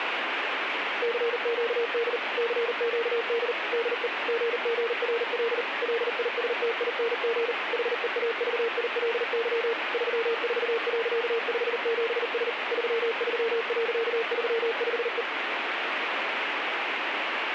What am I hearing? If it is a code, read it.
Morse code, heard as a keyed tone, machine-sent, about 39 wpm, 460 Hz, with radio static. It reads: CQD CQD DE GGRL LISTING HEAVILY 34.57S 33.35E